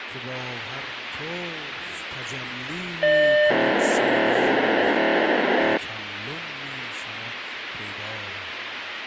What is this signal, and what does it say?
POCSAG pager data (1200 baud), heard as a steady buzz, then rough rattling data, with radio hiss.